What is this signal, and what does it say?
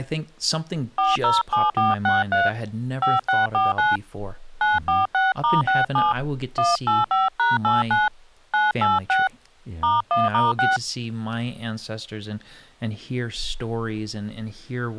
DTMF, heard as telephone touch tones, dialled by hand, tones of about 170 ms, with speech in English. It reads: 407463 5649 946*67 185#89 986 *1*6